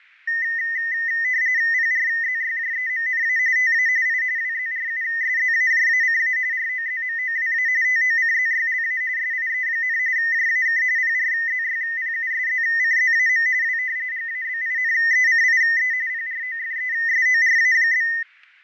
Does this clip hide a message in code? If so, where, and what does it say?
Yes: RTTY (45.45 baud, 170 Hz shift) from 0.3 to 18.2 s, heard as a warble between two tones, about 1900 Hz centre, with fading and static crashes. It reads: PRZYJEMNA TA I WZRUSZAJACA ROZMOWA TOCZYLA SIE, JAK PRZYPUSZCZAM W GABINECIE PROFESORA?